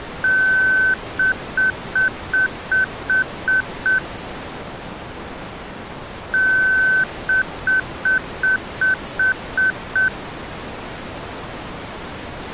Beep code, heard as beeps from a small speaker, played twice, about 1550 Hz. 1 long, 8 short. In AMI BIOS tables: display or retrace test failure.